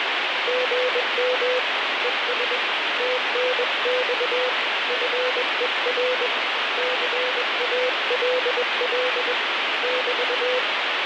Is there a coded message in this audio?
Yes: Morse code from 0.4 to 10.6 s, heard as a keyed tone, hand-sent with a paddle, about 21 wpm, 500 Hz, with heavy radio static. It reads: GM ES TNX FER CALL <BT>